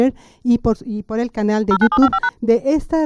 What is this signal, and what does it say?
DTMF, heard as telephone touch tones, dialled by machine, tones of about 60 ms. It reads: 09755#